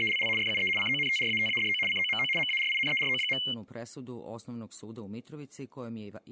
RTTY (75 baud, 850 Hz shift), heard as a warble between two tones, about 2550 Hz centre. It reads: … FUE CONTRATADO COMO MARINERO.